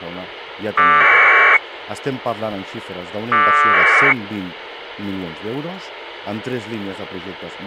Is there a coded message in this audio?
Yes: packet radio (AX.25, as in APRS), 1200 baud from 0.8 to 4.1 s, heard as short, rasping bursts, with radio hiss.